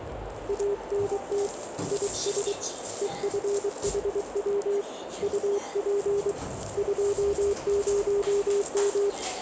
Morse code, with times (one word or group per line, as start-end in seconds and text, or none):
0.5-1.5 ANT
1.9-2.5 IS
3.0-4.8 EFHW
5.2-6.3 UP
6.8-9.1 20M